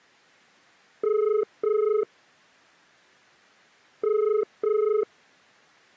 Telephone call progress tone (as in the UK, Ireland, Australia and similar networks), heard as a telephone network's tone, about 430 Hz. Ringback tone.